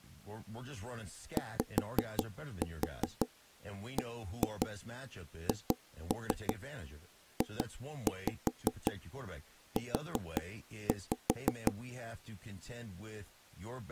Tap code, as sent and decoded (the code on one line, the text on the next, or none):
5-4 1-2 2-3 2-5 4-5
YBHJU